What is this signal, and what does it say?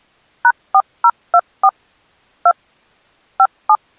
DTMF, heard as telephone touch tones, dialled by machine, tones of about 60 ms. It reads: #4024 2 57